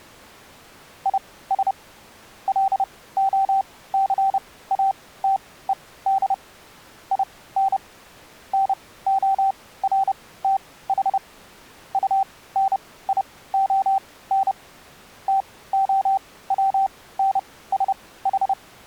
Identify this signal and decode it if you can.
Morse code, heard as a keyed tone, machine-sent, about 30 wpm, spaced as for 18 wpm, 780 Hz. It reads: IS LOCATED IN NORTH UNION …